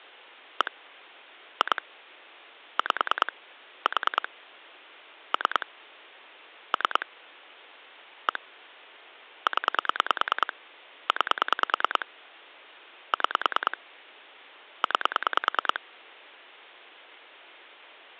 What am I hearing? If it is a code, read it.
Pulse dialling, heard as clicks on a phone line, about 9 pulses a second. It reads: 1 2 5 4 3 3 1 0 9 6 9